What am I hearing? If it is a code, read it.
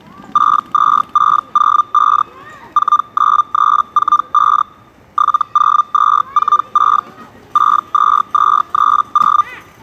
Hellschreiber (Feld-Hell, 122.5 baud), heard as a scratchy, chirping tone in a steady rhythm, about 1200 Hz, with the noise of a park. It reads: 62605 49345 70246 62230